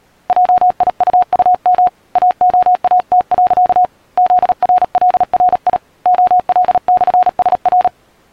Morse code, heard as a keyed tone, hand-sent with a paddle, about 37 wpm, 730 Hz. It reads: JIUUM AOAT. ZRLRI OL/SR